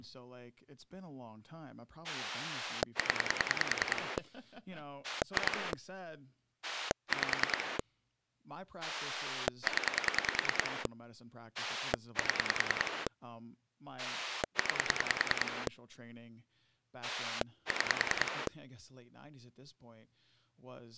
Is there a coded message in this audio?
Yes: pulse dialling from 2.0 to 18.5 s, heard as a rotary dial, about 10 pulses a second, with speech in English. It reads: 0 2 5 0 7 9 6